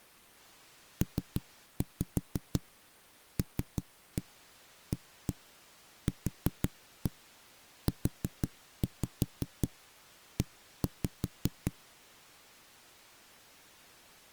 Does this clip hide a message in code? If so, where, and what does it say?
Yes: tap code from 1.0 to 11.7 s, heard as knocks on a wall, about 5 knocks a second. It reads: PLAQUE